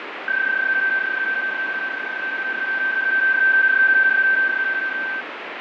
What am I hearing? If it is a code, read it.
PSK31 (31.25 baud), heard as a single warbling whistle, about 1550 Hz, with radio static and fading.